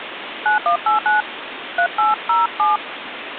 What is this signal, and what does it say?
DTMF, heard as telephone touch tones, dialled by hand, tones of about 140 ms, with phone line noise. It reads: 9189 3807